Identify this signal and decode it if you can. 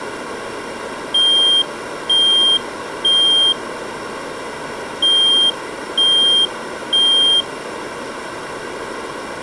Alarm pattern, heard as an alarm's beeps, played twice, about 3200 Hz. Temporal three. Smoke or fire, evacuate.